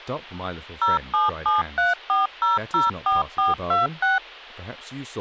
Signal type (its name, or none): DTMF